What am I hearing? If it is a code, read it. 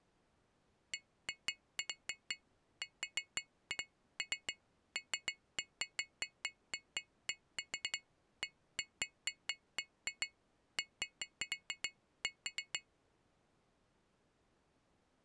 Irregular taps on glass. There is no code.